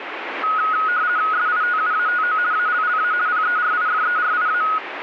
RTTY (50 baud, 170 Hz shift), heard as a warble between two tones, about 1360 Hz centre, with radio static. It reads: SITUATO ALLA PERIFERIA